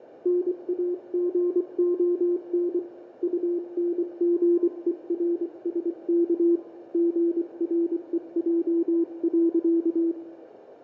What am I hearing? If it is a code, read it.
Morse code, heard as a keyed tone, hand-sent with a paddle, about 24 wpm, 340 Hz, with radio static and room echo. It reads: NAGON UNGERSK GREJ.